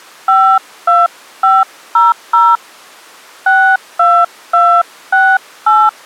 DTMF, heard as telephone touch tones, dialled by hand, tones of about 240 ms. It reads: 52500 62268